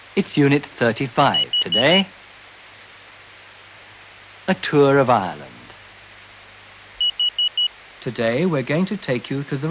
Alarm pattern, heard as an alarm's beeps, played twice, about 2950 Hz, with speech in English. Temporal four. Carbon monoxide.